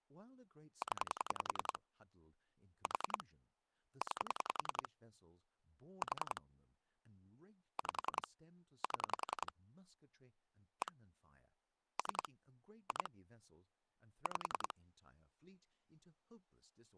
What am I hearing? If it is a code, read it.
Pulse dialling, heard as clicks on a phone line, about 10 pulses a second, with speech in English. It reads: 0 4 9 4 5 7 1 3 2 5